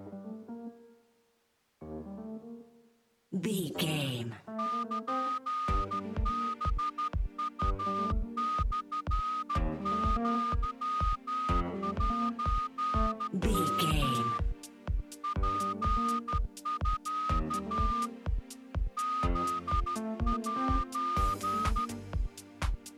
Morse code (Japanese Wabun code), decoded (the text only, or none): ルハウモアセヨ ツミ フセ